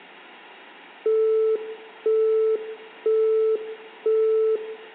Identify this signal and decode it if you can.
Telephone call progress tone (single-tone plan, as in Europe, Japan and elsewhere), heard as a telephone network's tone, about 440 Hz, 0.5 s on and 0.5 s off, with hum and room echo. Busy tone.